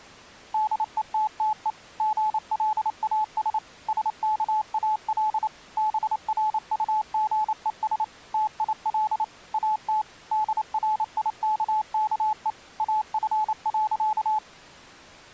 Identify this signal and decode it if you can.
Morse code, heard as a keyed tone, machine-sent, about 28 wpm, 860 Hz. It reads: DETTE GLAS SKAL BRUGES TIL AT DRIKKE AF.